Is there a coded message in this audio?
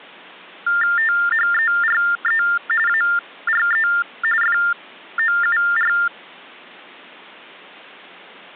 Yes: TTY/TDD text telephone tones (45.45 baud Baudot) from 0.7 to 6.1 s, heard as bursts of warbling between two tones, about 400 Hz shift, 1600 Hz centre. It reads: THERE ARE FOUR